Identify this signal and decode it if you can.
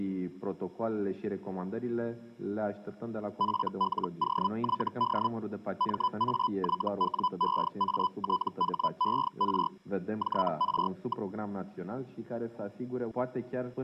Hellschreiber (Feld-Hell, 122.5 baud), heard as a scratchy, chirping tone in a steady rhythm, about 1000 Hz. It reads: FLOYD MAYWEATHER JR.